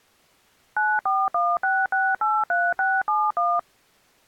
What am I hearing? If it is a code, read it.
DTMF, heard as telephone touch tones, dialled by machine, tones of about 230 ms. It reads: 9416683671